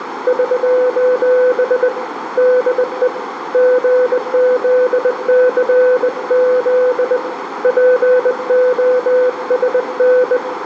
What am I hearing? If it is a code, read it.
Morse code, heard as a keyed tone, hand-sent with a bug key, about 20 wpm, 500 Hz, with radio static, a narrow filter and room echo. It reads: <SOS> DE GZCZ POSN